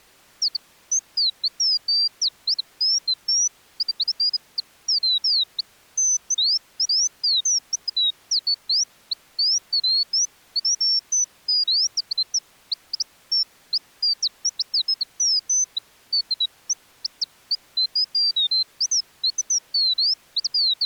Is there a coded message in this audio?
No, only bird-like chirps.